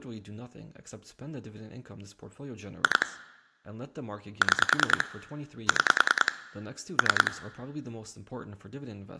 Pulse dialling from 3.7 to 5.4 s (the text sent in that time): 6